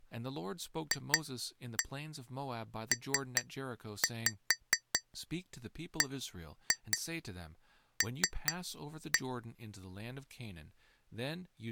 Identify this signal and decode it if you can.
Tap code, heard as taps on glass, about 4 knocks a second, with speech in English. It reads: FPBL